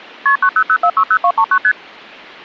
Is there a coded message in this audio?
Yes: multi-frequency trunk signalling (R1, as on North American trunks) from 0.3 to 1.7 s, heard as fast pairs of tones, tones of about 70 ms. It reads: KP 900460239 ST